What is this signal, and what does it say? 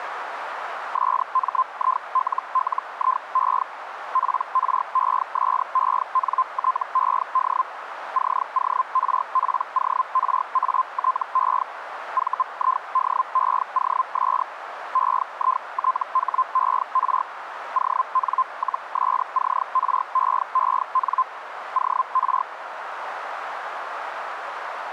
Hellschreiber (Feld-Hell, 122.5 baud), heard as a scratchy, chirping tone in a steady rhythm, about 1040 Hz, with radio static and a narrow filter. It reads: SMILLIE PRESENTED CORPORATE VIDEOS EITHER ON-SCREEN OR